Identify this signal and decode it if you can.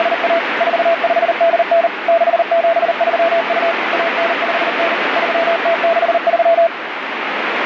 Morse code (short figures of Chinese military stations), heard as a keyed tone, machine-sent, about 39 wpm, 670 Hz, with heavy radio static. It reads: … 4589 6732 1959 3063